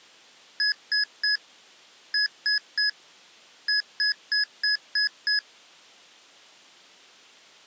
Beep code, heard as beeps from a small speaker, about 1700 Hz. 3-3-6.